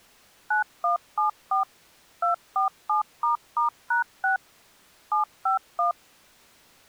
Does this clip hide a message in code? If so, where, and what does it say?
Yes: DTMF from 0.5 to 5.9 s, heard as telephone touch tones, dialled by machine, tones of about 120 ms. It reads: 9174 247**#6 751